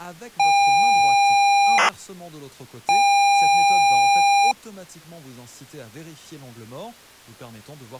ZX Spectrum tape loading, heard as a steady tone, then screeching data, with speech in French.